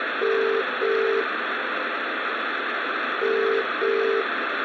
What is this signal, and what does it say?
Telephone call progress tone (as in the UK, Ireland, Australia and similar networks), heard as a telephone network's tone, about 400, 450 Hz, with phone line noise and room echo. Ringback tone.